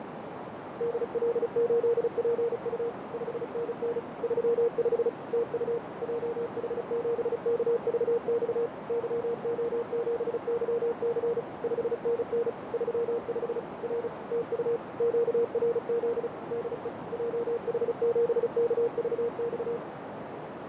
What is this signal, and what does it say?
Morse code, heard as a keyed tone, machine-sent, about 35 wpm, 470 Hz, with heavy radio static, fading and a narrow filter. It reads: DL8PU 5NN 35 TU JH7KVX YO7YC 5NN 35 R TU QRZ DE JH7KVX